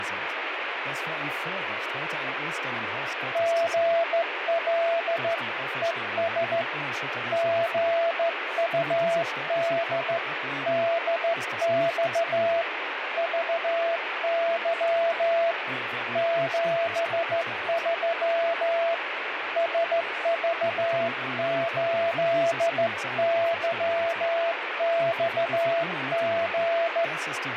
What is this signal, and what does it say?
Morse code, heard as a keyed tone, hand-sent with a straight key, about 14 wpm, 670 Hz, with radio static. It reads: GL ES GUD DX VY 73 SV8YXG